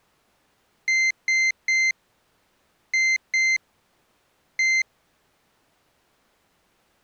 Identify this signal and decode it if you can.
Beep code, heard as a piezo beeper, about 2100 Hz. 3-2-1.